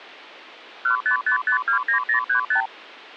Multi-frequency trunk signalling (R2, with the far end's replies), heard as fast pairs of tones, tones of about 100 ms. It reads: 155529035